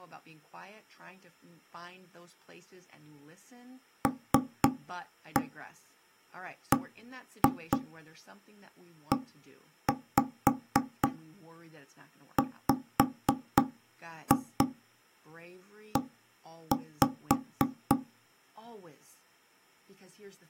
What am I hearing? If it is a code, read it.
Tap code, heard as knocks on wood, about 3 knocks a second, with speech in English. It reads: LBEWE